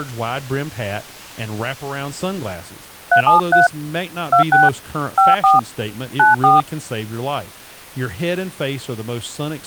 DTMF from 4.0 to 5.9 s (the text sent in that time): 26 54